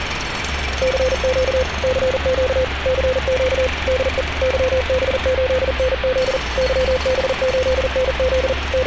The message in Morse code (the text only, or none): CQ CQ CQ DE YB8NZ YB8NZ …